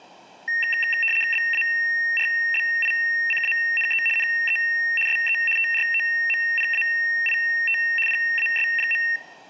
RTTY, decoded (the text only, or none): BARBICANE NE SE TROMPAIT PAS.